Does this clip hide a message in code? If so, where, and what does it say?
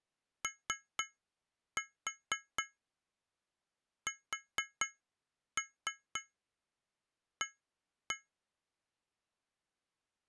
Yes: tap code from 0.4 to 8.3 s, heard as taps on glass, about 4 knocks a second. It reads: OSA